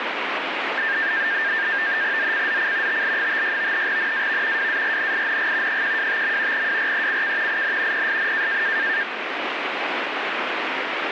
NAVTEX (SITOR-B), 100 baud, 170 Hz shift, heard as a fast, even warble, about 1700 Hz centre, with radio static. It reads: ZCZC TL56 NAV WARNING 125. WRECK IN PSN